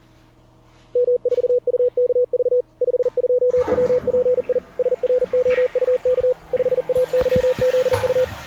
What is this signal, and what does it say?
Morse code, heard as a keyed tone, machine-sent, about 40 wpm, 500 Hz, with the noise of a restroom. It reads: M4UKV 52WPI SROUK 5AYZU